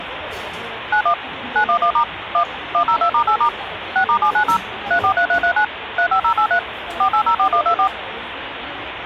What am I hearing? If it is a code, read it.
DTMF, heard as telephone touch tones, dialled by machine, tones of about 90 ms, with phone line noise and the noise of a cafe. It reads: 91 911* 1 102*8* 6*790 343339 35083 4804124